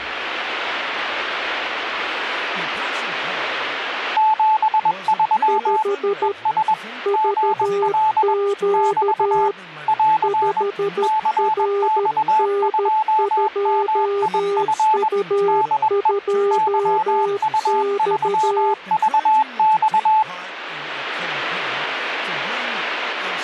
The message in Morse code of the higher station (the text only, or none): 73 ES GL <BT> <AR> CX2MIF DE YU3VX